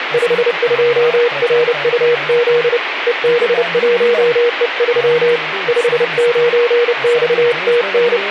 Morse code, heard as a keyed tone, hand-sent with a paddle, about 30 wpm, 480 Hz, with radio static and speech in Sindhi. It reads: 52RUZ EB1E3 59XTN